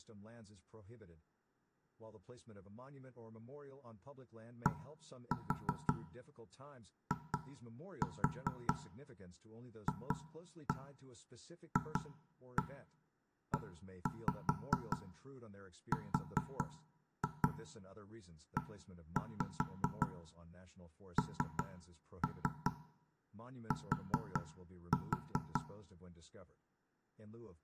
Tap code, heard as knocks on wood, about 5 knocks a second, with room echo and speech in English. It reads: DIFFERENT